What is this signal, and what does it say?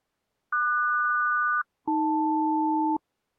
Aircraft SELCAL, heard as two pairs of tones. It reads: QS-AL